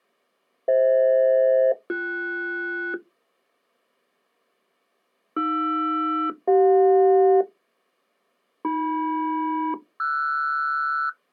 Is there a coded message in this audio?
Yes: aircraft SELCAL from 0.7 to 11.1 s, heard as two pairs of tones. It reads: FH-BS AR-CJ AM-RS